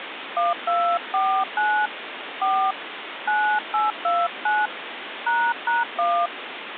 DTMF, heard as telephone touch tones, dialled by hand, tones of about 250 ms, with phone line noise. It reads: 1249 4 9829 ##1